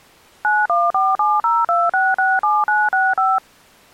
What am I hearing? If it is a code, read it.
DTMF, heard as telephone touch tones, dialled by machine, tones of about 210 ms. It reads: 914702667965